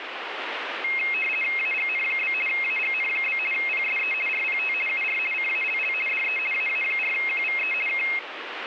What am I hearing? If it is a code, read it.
RTTY (50 baud, 450 Hz shift), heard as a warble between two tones, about 2350 Hz centre, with radio static. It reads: AGN? AGN? PSE RPT UR CALL DE AA4QVE K